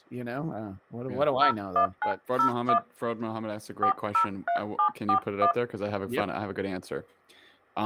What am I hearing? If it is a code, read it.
DTMF, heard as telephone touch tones, dialled by hand, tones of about 100 ms, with speech in English. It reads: 01901 403741